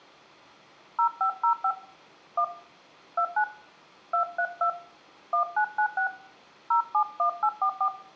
DTMF, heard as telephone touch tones, dialled by hand, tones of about 90 ms, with room echo. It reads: 0505 1 29 232 1996 071844